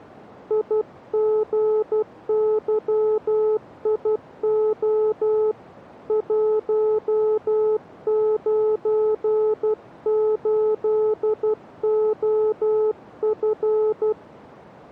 Morse code, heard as a keyed tone, hand-sent with a paddle, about 12 wpm, 430 Hz. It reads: IGYIO 198OF